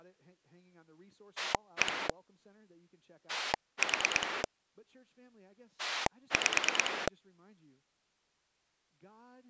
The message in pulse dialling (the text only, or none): 1 4 5